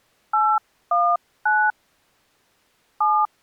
DTMF, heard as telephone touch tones, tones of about 250 ms. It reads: 819 7